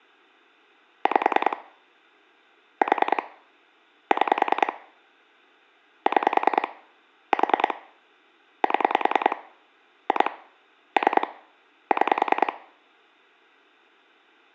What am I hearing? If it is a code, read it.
Pulse dialling, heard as clicks on a phone line, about 10 pulses a second. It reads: 5 4 6 6 4 7 2 3 6